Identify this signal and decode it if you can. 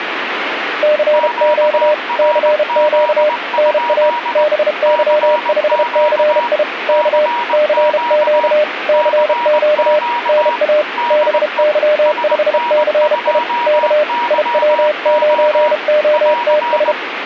Morse code, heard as two keyed tones, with radio static. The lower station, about 32 wpm, 600 Hz: CQ CQ NA BY5CI K CQ CQ NA BY5CI K IW9OTS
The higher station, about 20 wpm, 960 Hz: QRZ? CQ CQ CQ DE SN2YO <AR>